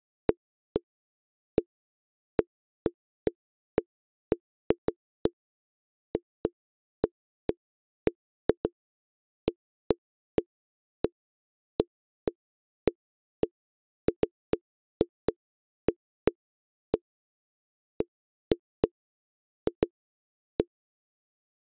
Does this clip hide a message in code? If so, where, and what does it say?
No, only irregular knocks on a wall.